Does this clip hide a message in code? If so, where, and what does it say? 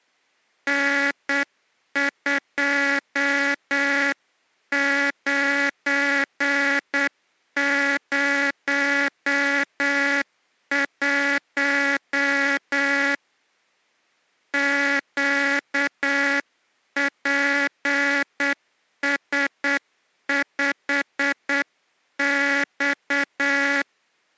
Yes: Morse code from 0.6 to 23.9 s, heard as a buzzer, hand-sent with a straight key, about 8 wpm. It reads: N2901 QPS5X